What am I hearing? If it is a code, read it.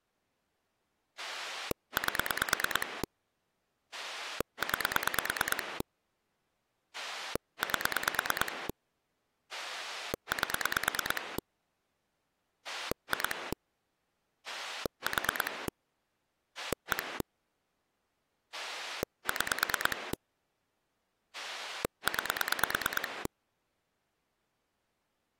Pulse dialling, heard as a rotary dial, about 9 pulses a second. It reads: 8 9 8 8 2 4 1 6 9